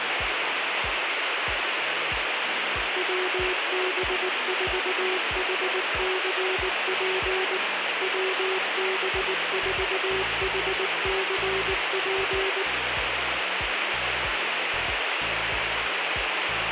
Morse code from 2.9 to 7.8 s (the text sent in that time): WB4HCP